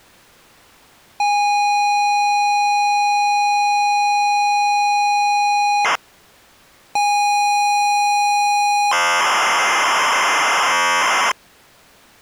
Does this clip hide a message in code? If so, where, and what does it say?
Yes: ZX Spectrum tape loading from 1.2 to 11.3 s, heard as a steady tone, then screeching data.